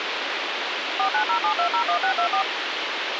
DTMF, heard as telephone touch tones, dialled by machine, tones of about 90 ms, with radio hiss. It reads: 4907201624